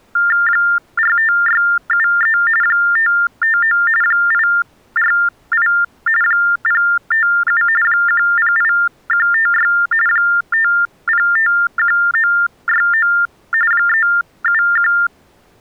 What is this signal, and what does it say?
TTY/TDD text telephone tones (45.45 baud Baudot), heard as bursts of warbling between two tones, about 400 Hz shift, 1600 Hz centre. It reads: 45673 559 848 057 108156 5051969 371